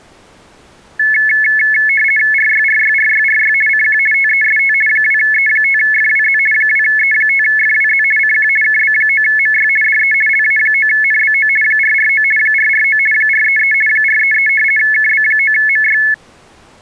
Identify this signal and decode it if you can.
RTTY (50 baud, 450 Hz shift), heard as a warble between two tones, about 1950 Hz centre. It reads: RYRYRYRY CQ TEST 2E5FWZ 2E5FWZ CQ KB9MY DE LA9NBO 449 449 433 433 KB9MY